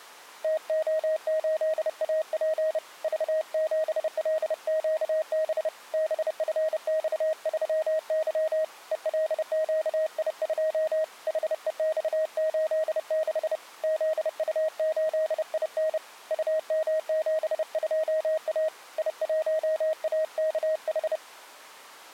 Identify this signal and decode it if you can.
Morse code, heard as a keyed tone, hand-sent with a paddle, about 30 wpm, 630 Hz. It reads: TO8AP V7LQB BFX3Y ELQI2 HEX86 ZU8IN UM72A I1AKH